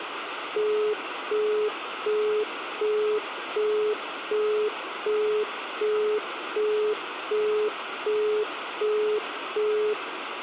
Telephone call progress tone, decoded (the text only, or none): busy tone